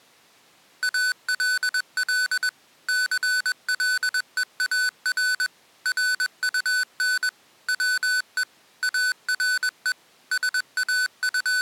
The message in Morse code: ALL CLEAR RUN WE ARE …

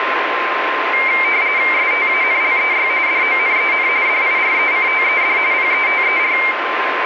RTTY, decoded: STANLEY DONEN DIRECTED PETER

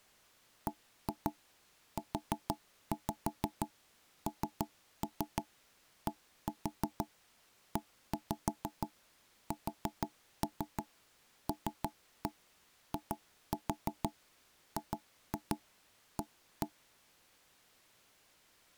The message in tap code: BUNDESLIGA

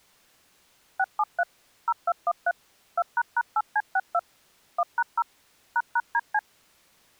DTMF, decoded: 673 0213 2##8C62 1#0 ##DC

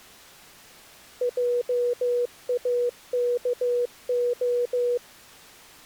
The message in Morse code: JAKO

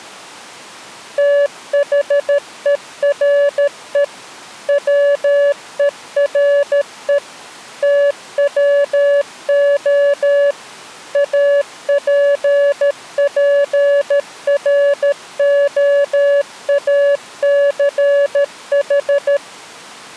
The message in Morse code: THERE WERE TWO APPROACH

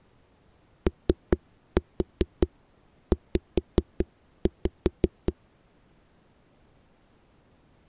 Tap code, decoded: OZ

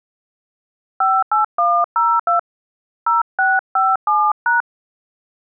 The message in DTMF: 58102 0657#

